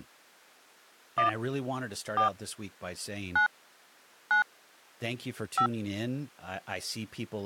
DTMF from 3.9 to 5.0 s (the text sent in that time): 9